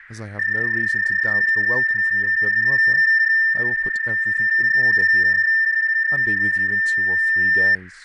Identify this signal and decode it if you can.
PSK31 (31.25 baud), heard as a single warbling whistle, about 1800 Hz, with radio static, fading and speech in English.